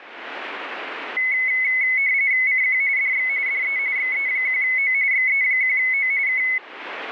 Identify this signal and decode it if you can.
RTTY (45.45 baud, 170 Hz shift), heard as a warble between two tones, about 2100 Hz centre. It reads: CQ DX DE XE1O XE1O K